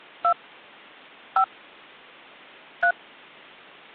DTMF, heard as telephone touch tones, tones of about 80 ms. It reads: 2 5 3